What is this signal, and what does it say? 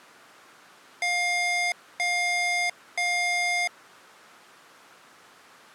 Beep code, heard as beeps from a small speaker, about 710 Hz. 3 long. In IBM BIOS tables: keyboard card error.